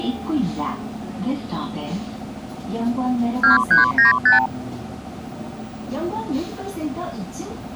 Multi-frequency trunk signalling (R2, with the far end's replies), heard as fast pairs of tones, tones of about 140 ms, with the noise inside a bus. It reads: 2395